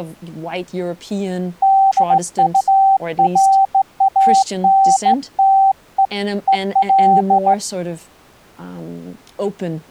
Morse code, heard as a keyed tone, hand-sent with a straight key, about 16 wpm, 780 Hz, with speech in English. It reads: DURANTE EL